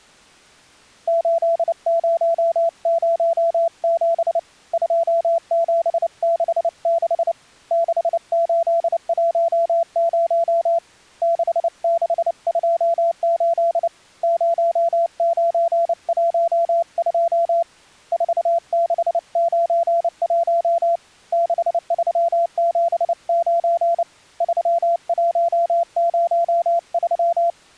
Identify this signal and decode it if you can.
Morse code, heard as a keyed tone, hand-sent with a paddle, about 29 wpm, 680 Hz. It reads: 8007 2766 6810 6628 0912 4691 6379 3103